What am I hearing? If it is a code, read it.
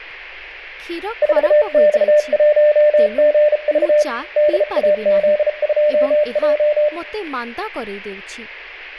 Morse code, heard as a keyed tone, hand-sent with a bug key, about 34 wpm, 600 Hz, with room echo and speech in Odia. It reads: 4X1GV DAZ2J